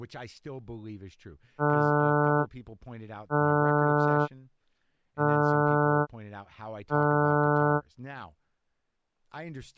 Ship horn signal, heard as a ship's horn, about 150 Hz, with speech in English. 4 short. At sea: a pilot vessel's identity signal in fog.